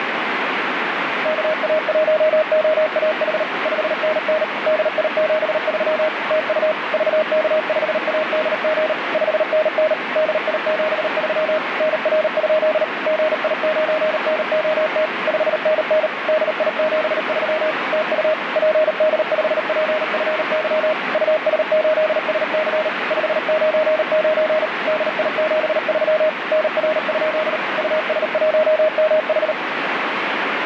Morse code, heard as a keyed tone, machine-sent, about 38 wpm, 620 Hz, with radio static. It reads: KA1OAH 5NN DI73 TU VK5ADG 5NN DI73 NR? GI9NOT 5NN DI73 TU PD5PFY US8SC 599 DI73 NR? US1MH